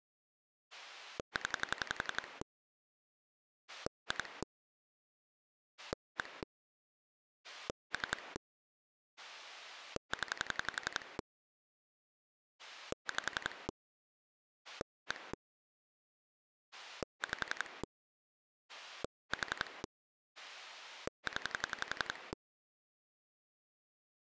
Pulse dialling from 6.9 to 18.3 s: 3 0 5 1 5

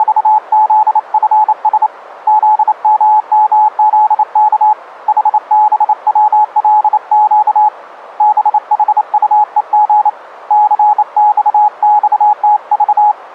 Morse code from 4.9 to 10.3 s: HBWLQ BHUEG

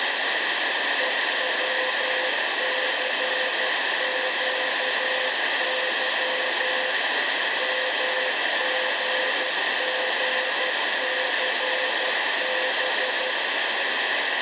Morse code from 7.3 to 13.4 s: MGGCB

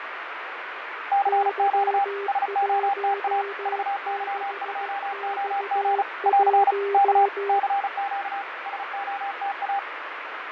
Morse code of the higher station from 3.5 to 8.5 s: VY2OG <AR> K CQ

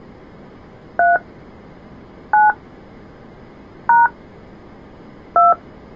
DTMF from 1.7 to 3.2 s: 9

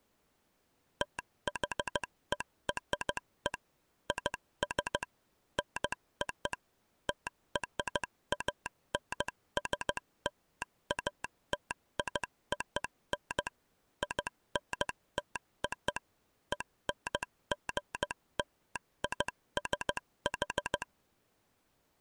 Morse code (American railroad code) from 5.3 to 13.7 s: NO TRANSLATION

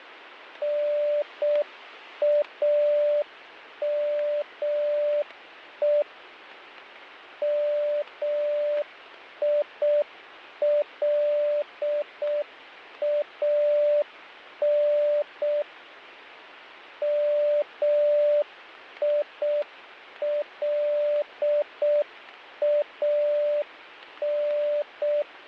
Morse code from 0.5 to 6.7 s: NAME

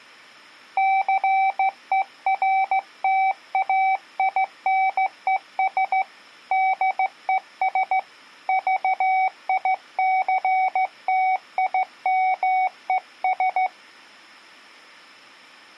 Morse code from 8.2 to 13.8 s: VICTIMES

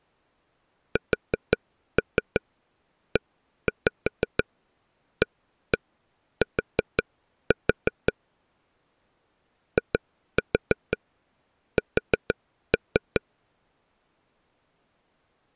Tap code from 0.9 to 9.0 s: SEAT

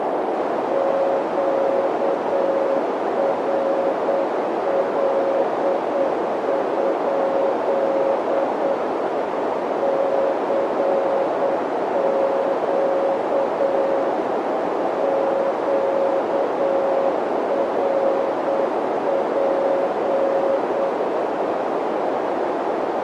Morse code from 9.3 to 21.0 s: CQ QRP

